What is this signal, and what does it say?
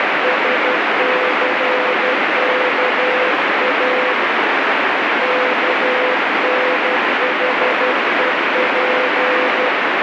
Morse code (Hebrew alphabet), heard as a keyed tone, hand-sent with a paddle, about 12 wpm, 500 Hz, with heavy radio static. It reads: שסכא כנחוף